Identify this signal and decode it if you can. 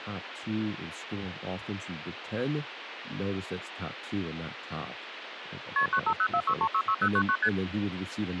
Multi-frequency trunk signalling (R1, as on North American trunks), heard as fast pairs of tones, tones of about 70 ms, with phone line noise and speech in English. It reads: KP 95046366099 ST